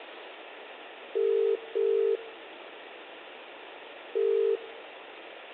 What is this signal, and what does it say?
Telephone call progress tone (as in the UK, Ireland, Australia and similar networks), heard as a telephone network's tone, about 400, 450 Hz, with phone line noise and room echo. Ringback tone.